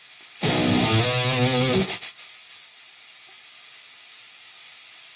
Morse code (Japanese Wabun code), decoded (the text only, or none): none